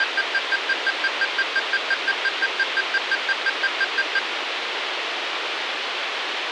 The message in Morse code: none

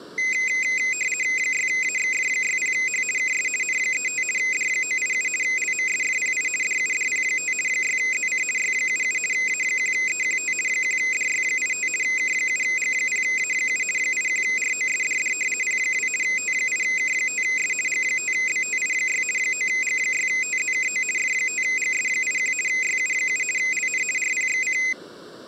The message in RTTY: 6AXF60H KS N35 D987 LMSFPI DUDP5 6ZC Y77 A1EQT 1DY85 K7G0A7 81ROSDD P2 T8K5S G5BTI6 9G6TZKO F5GS81 YU7 LN RPXC

